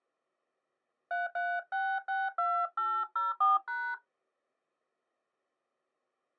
DTMF, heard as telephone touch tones, dialled by hand, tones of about 220 ms. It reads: 33662804#